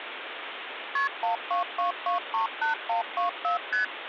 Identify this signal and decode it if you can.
Multi-frequency trunk signalling (R1, as on North American trunks), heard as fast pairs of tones, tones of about 120 ms, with phone line noise. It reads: KP 122238124 ST